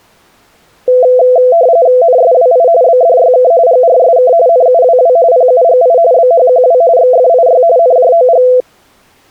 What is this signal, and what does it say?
RTTY (45.45 baud, 170 Hz shift), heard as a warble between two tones, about 590 Hz centre. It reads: NSWI BDYK GRSK NUWW PUGI BHQW XFIY NJOG